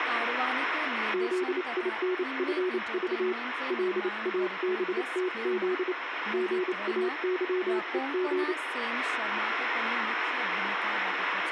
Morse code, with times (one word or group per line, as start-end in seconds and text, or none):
1.1-3.3 ZINFV
3.7-5.9 LABTZ
6.3-8.5 GAYEG